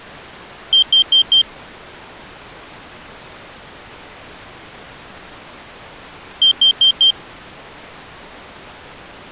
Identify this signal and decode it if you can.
Alarm pattern, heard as an alarm's beeps, played twice, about 3150 Hz. Temporal four. Carbon monoxide.